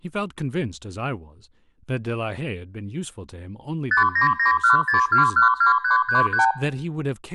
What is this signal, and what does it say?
Multi-frequency trunk signalling (R2, with the far end's replies), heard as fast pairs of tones, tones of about 120 ms, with speech in English. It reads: 59916212333